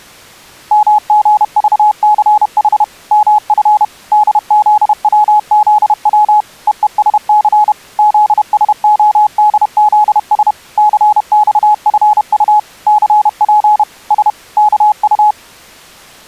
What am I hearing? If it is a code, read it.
Morse code, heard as a keyed tone, machine-sent, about 31 wpm, 840 Hz. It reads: MGVCH MF DZWZW EESC ZSODZS CXFU CP S KU